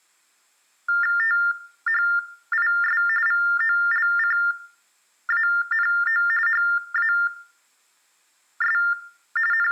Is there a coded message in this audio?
Yes: TTY/TDD text telephone tones (45.45 baud Baudot) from 0.9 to 9.7 s, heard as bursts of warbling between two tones, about 400 Hz shift, 1600 Hz centre, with room echo. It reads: THIS VOLCANO HAS …